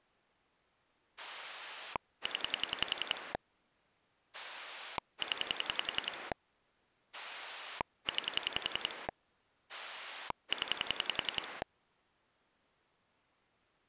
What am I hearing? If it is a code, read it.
Pulse dialling, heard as a rotary dial, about 10 pulses a second. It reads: 0 0 9 0